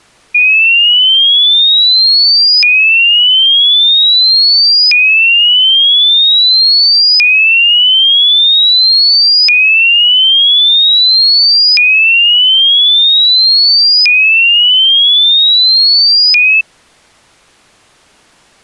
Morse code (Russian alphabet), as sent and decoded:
none

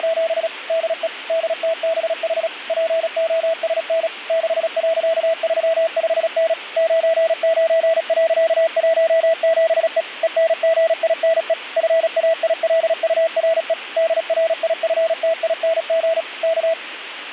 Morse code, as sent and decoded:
… / -.. . / -.. - -... .... / .--. --- ... -. / -.... .-.-.- ...-- ..... -. / ----. ----. .-.-.- .---- --... . / . -. --. .. -. . / ..-. .- .. .-.. ..- .-. . / -.. .-. .. ..-. - .. -. --. / -.-
… DE DTBH POSN 6.35N 99.17E ENGINE FAILURE DRIFTING K

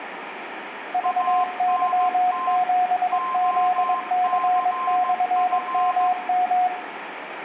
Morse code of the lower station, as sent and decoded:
...- -.-- --... --.. -.-. -..-. -- --
VY7ZC/MM

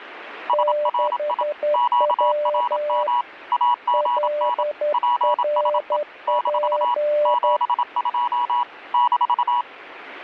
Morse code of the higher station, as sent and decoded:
... .-. .. / --.- .-. -- / .- --. -. / .--. ... . / -....- / --... ..--- / -....-
SRI QRM AGN PSE - 72 -

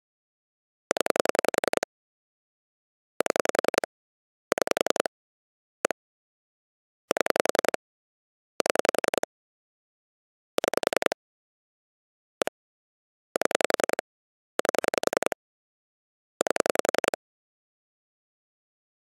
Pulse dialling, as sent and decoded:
10 / 7 / 6 / 1 / 7 / 7 / 6 / 1 / 7 / 8 / 8
0 7 6 1 7 7 6 1 7 8 8

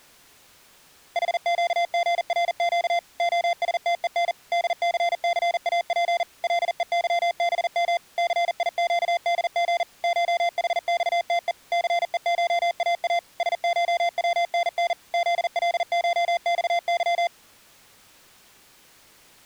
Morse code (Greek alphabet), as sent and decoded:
.... --.- --. .-. --.- / --- ... - . -. / -.. -.-. -.-. .- .--. / .-.. . -.-- -... -- / -.-. .. --.- -.. --. / ---- .... -..- - . / -.-. . ---- .- .- / ... ---- .-- -. -. / --.. .-.. ---- -..- -.--
ΗΨΓΡΨ ΟΣΤΕΝ ΔΘΘΑΠ ΛΕΥΒΜ ΘΙΨΔΓ ΧΗΞΤΕ ΘΕΧΑΑ ΣΧΩΝΝ ΖΛΧΞΥ

